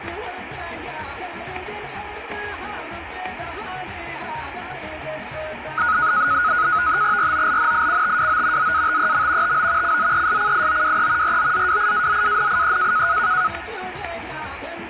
NAVTEX (SITOR-B), 100 baud, 170 Hz shift, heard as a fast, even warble, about 1360 Hz centre, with static crashes. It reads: ROLNICTWO ZATEM TO CZESCIOWE ROZWIAZANIE